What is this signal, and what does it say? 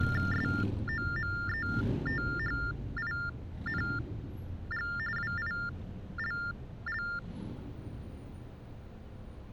TTY/TDD text telephone tones (45.45 baud Baudot), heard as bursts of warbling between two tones, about 400 Hz shift, 1600 Hz centre, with street noise. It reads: SOMETHING WILL